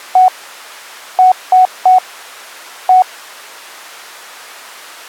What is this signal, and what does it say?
Beep code, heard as beeps, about 740 Hz. 1-3-1. In Phoenix BIOS tables: memory refresh failure.